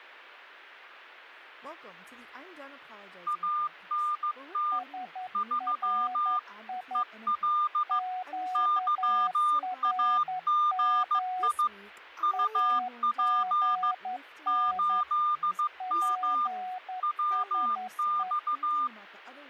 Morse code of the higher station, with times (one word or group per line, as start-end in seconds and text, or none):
3.3-4.8 ANT
5.4-6.4 3
7.0-8.0 EL
8.6-11.7 YAGI
12.2-13.9 UP
14.5-16.5 8M
17.0-18.9 WX